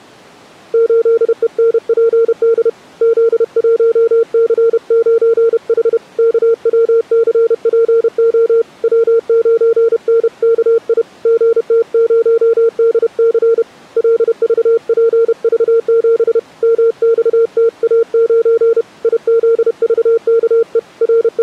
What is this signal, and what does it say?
Morse code, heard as a keyed tone, hand-sent with a paddle, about 31 wpm, 460 Hz. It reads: 8ENPD Z1C9H KWCPO W9NKI GT0DC LVPV7 MXTA9 IZVKE …